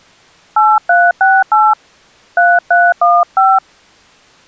DTMF, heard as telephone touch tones, dialled by hand, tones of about 220 ms. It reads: 8368 3315